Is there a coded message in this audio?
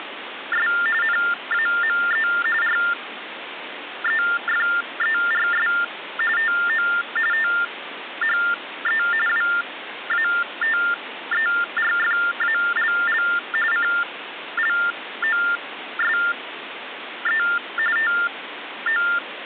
Yes: TTY/TDD text telephone tones (45.45 baud Baudot) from 0.0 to 19.2 s, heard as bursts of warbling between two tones, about 400 Hz shift, 1600 Hz centre, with phone line noise. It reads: … NAME REFERS TO THE WATERFALL CLOSE TO